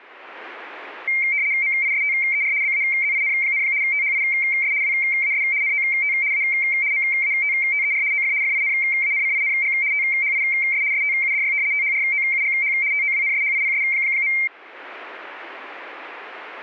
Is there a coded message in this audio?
Yes: RTTY (75 baud, 170 Hz shift) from 1.1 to 14.5 s, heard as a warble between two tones, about 2200 Hz centre. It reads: MISTER BAZIN, THIS WAS NOT A MATTER OF FINANCING THIS STUDY THROUGH TOWNSHIPS.